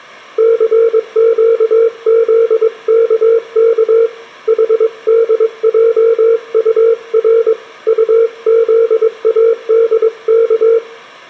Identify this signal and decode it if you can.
Morse code, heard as a keyed tone, hand-sent with a paddle, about 22 wpm, 460 Hz, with room echo. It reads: CQZKK HDJUR UZADK